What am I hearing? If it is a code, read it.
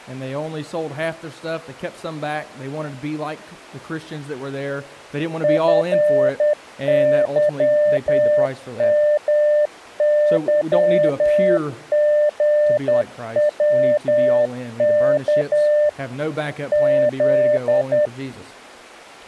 Morse code, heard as a keyed tone, machine-sent, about 10 wpm, 600 Hz. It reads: FYMYGWK Z